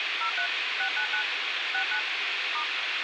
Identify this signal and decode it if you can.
DTMF, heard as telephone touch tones, dialled by machine, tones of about 90 ms, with radio hiss. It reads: 03 699 69 *